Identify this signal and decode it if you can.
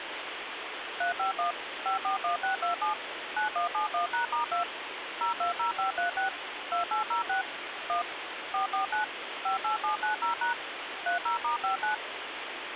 DTMF, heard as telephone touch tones, dialled by machine, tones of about 120 ms, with phone line noise. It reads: 351 541627 9171#*2 020536 2806 1 449 58790# 30*59